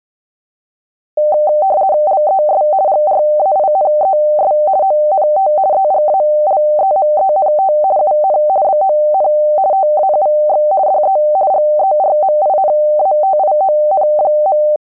RTTY (50 baud, 170 Hz shift), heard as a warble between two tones, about 690 Hz centre. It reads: LES GRAINES ONT EGALEMENT UN BON TAUX DE GERMINATION.